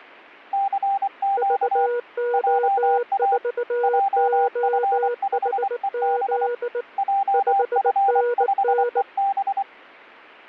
Morse code, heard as two keyed tones. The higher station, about 24 wpm, 790 Hz: CQ JA JF5EB JF5EB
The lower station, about 19 wpm, 480 Hz: VO4OHZ 5NN